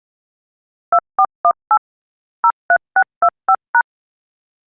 DTMF, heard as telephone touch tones, dialled by machine, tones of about 60 ms. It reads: 2418 03625#